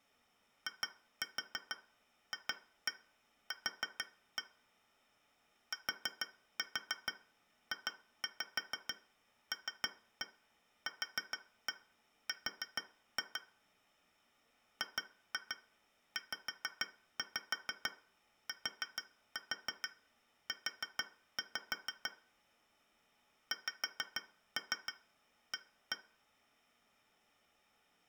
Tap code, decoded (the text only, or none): IFQ TJLQR GZTU XA